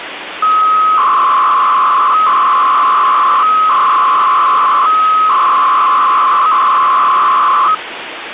300-baud modem data (Bell 103 tones), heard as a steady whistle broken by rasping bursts, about 300 baud, 200 Hz shift, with phone line noise.